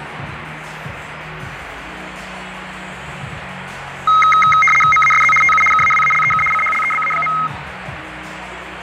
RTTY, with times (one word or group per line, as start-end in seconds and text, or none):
4.9-5.3 MASZ
5.4-5.6 TU
5.7-6.4 KAWALEK
6.5-7.3 CHLEBA.